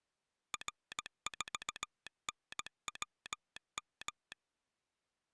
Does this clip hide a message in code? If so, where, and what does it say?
Yes: Morse code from 0.5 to 4.4 s, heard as a telegraph sounder, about 17 wpm. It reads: R4NWM